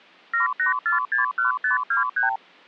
Multi-frequency trunk signalling (R2, with the far end's replies), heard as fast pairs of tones, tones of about 130 ms. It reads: 78461523